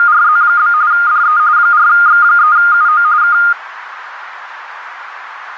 RTTY (45.45 baud, 170 Hz shift), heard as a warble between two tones, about 1320 Hz centre, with radio static. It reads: … DE 4X3UO K